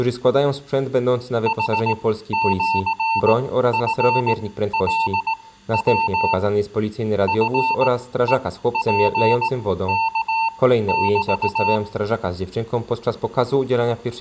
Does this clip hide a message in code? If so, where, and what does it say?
Yes: Morse code (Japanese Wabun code) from 1.4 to 11.8 s, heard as a keyed tone, machine-sent, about 18 wpm, spaced as for 13 wpm, 900 Hz. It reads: ヌシチカヤ チヘツワメ